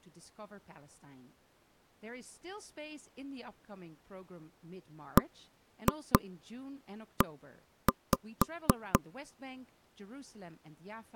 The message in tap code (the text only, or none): BE